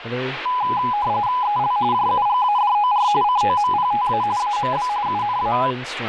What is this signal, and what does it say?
RTTY (45.45 baud, 170 Hz shift), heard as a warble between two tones, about 920 Hz centre, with radio static and speech in English. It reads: EL JUGADOR COMPTA AMB UNA